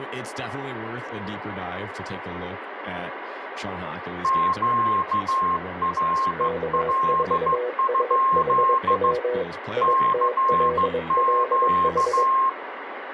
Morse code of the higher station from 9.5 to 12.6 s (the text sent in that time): CQ